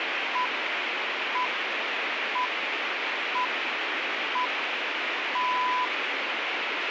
Radio time signal (six pips, as the Greenwich Time Signal), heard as pips, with radio hiss.